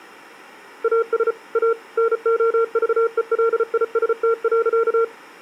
Morse code, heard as a keyed tone, machine-sent, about 34 wpm, 460 Hz. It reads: AS A NOVELIST.